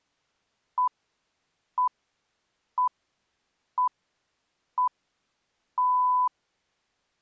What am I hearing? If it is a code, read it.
Radio time signal (six pips, as the Greenwich Time Signal), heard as pips.